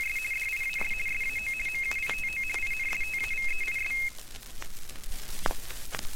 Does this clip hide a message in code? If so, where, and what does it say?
Yes: RTTY (50 baud, 450 Hz shift) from 0.0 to 4.1 s, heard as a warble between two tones, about 2350 Hz centre, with room echo. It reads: … DIAS SAO MUITO INSTAVEIS